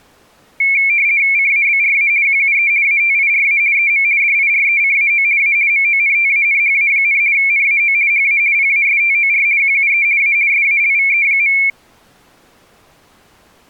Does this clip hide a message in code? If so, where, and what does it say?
Yes: RTTY (50 baud, 170 Hz shift) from 0.6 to 11.7 s, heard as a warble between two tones, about 2300 Hz centre. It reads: CABRA QUE ATIRA EM DIRECAO A MONTANHA, NAO HA PASTOR QUE A SALVE.